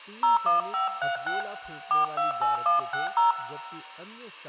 DTMF, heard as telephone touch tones, dialled by hand, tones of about 140 ms, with room echo and speech in Hindi. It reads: 01536 428160